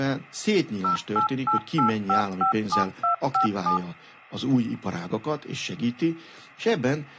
DTMF, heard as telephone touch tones, dialled by machine, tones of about 110 ms, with speech in Hungarian. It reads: 0888557257